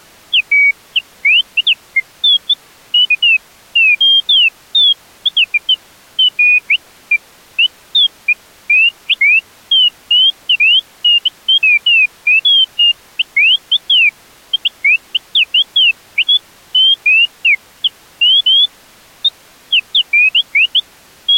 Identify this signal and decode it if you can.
Bird-like chirps. There is no code.